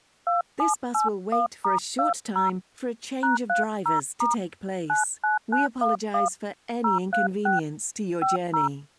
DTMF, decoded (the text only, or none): 2781*20 #30* 99911 036 50